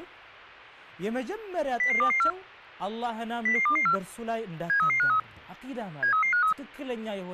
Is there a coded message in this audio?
Yes: five-tone selective call (CCIR) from 1.8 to 6.5 s, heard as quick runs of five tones, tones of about 100 ms, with speech in Arabic. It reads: 00224 00224 73353 73353